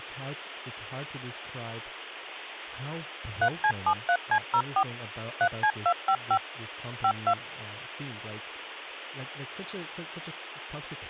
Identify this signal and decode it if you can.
DTMF, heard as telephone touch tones, dialled by machine, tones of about 70 ms, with speech in English. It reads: 3C73C04 3C255 52